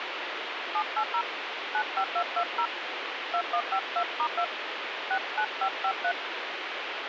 DTMF, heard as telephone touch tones, dialled by hand, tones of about 80 ms, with radio hiss. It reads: 780 95220 2152*2 69553